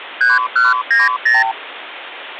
Multi-frequency trunk signalling (R2, with the far end's replies), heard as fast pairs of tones, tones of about 170 ms, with phone line noise. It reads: 3190